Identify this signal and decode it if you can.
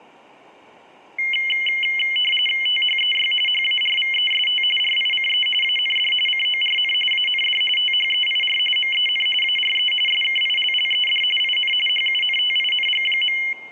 RTTY (45.45 baud, 850 Hz shift), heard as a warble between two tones, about 2550 Hz centre. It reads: THEY HARVEST RICE AND CORN AND THEIR MEN ARE SKILLED IN HUNTING.